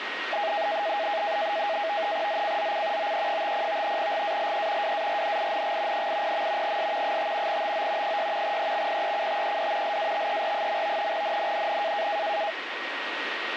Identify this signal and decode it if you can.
NAVTEX (SITOR-B), 100 baud, 170 Hz shift, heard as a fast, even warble, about 740 Hz centre, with radio static and a steady whistle near 1880 Hz. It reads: ZCZC OE50 GALE WARNING 80. S 5 TO 6 EXPECTED LATER. NNNN